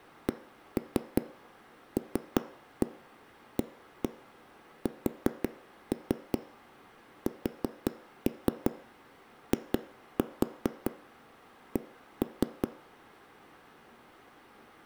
Tap code, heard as knocks on a wall, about 5 knocks a second, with room echo. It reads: CLASSIC